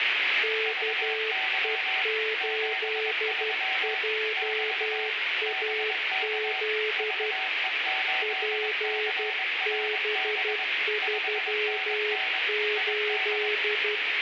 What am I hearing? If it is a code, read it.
Morse code, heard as two keyed tones, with radio static. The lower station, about 12 wpm, 430 Hz: KE8JAZ PB38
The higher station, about 22 wpm, 760 Hz: VY 73 <BT> BK VE8CRB 5NN ID